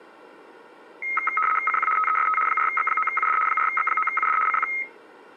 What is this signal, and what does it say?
RTTY (75 baud, 850 Hz shift), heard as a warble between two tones, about 1700 Hz centre. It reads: CQ TEST 4X9UD 4X9UD CQ